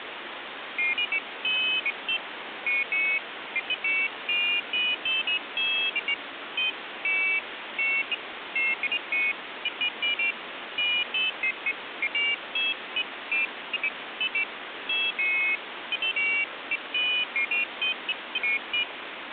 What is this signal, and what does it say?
Pairs of high tones at irregular times, with phone line noise. There is no code.